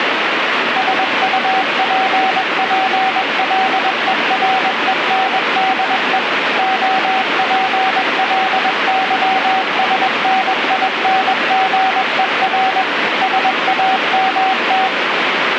Morse code, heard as a keyed tone, machine-sent, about 21 wpm, 760 Hz, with heavy radio static. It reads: SUPPLERENDE OPLYSNINGER SAMT